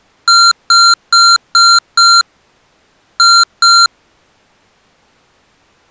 Beep code, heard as beeps from a small speaker, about 1380 Hz. 5-2.